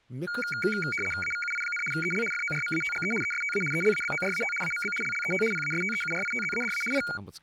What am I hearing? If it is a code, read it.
RTTY (75 baud, 850 Hz shift), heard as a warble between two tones, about 1850 Hz centre, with speech in Kashmiri. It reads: AVUI, EL FORMATGE ESTA ELABORAT AMB LLET PASTEURITZADA I